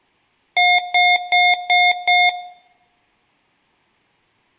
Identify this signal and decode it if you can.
Beep code, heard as beeps from a small speaker, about 720 Hz, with room echo. 5 short. In AMI BIOS tables: processor failure; in Dell tables: CMOS battery failure.